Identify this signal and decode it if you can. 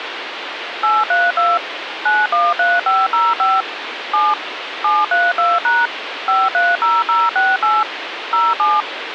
DTMF, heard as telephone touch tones, dialled by machine, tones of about 200 ms, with phone line noise. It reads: 832 913505 7 732# 530068 07